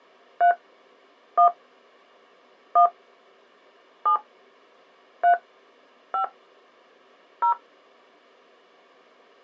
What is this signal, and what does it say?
DTMF, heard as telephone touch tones, dialled by hand, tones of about 100 ms. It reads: 3 1 1 7 3 5 0